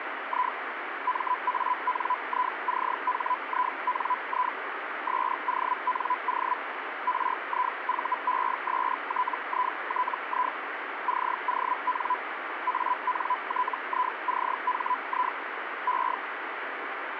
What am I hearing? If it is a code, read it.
Hellschreiber (Feld-Hell, 122.5 baud), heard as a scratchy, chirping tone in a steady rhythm, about 1000 Hz, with radio static. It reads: I MANICHINI SONO RIVESTITI CON ANTICHI E